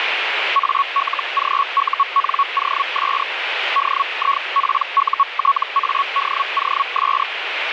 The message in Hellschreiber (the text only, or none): ALGUNOS DIPUTADOS